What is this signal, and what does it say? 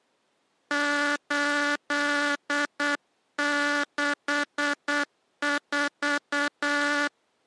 Morse code, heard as a buzzer, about 8 wpm. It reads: 864